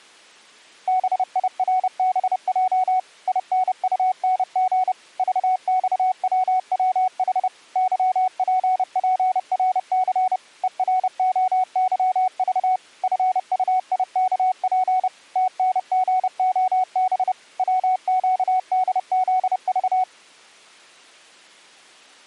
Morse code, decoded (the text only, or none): BIRBJ INUNG VXWWH YPPRC EROYV FUIKP TNGOB WQDZV